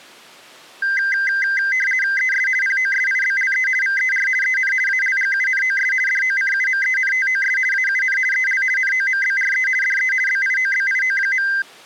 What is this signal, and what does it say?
RTTY (50 baud, 450 Hz shift), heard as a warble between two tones, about 1800 Hz centre. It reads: ES POSIBLE VER EN ALGUNOS DOCUMENTOS AUN EL NOMBRE DE BIOBIO.